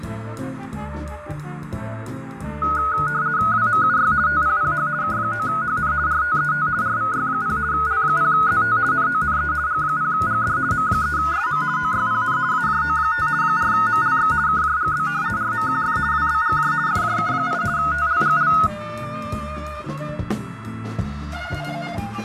RTTY (50 baud, 170 Hz shift), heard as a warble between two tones, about 1360 Hz centre, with radio static. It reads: WMUY TPPH K9HN RTET RVY0 L0ZT NONE G0GD M3SM OYPN AJO5 4MLX KJGB RMQF WBGJ FJK8 TLGL